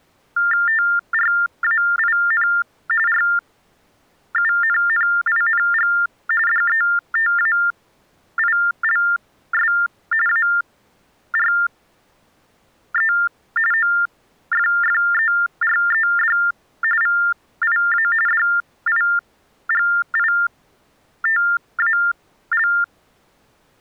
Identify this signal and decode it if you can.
TTY/TDD text telephone tones (45.45 baud Baudot), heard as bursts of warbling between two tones, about 400 Hz shift, 1600 Hz centre. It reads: TRAIN RUNNING DETAILS ARE OFFERED VIA DIGITAL